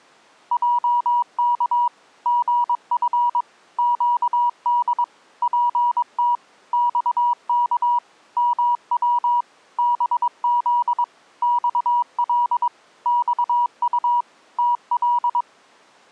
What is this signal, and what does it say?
Morse code, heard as a keyed tone, machine-sent, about 22 wpm, 960 Hz. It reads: JK GF QD PT XK MW BZ XL XU TL